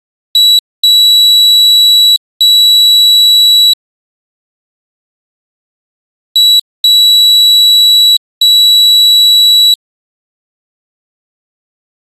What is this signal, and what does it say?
Beep code, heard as a piezo beeper, played twice, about 3900 Hz. 1 short, 2 long.